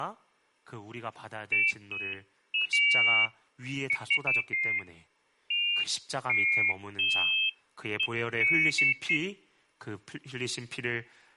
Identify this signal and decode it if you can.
Pairs of high tones at irregular times, with speech in Korean. There is no code.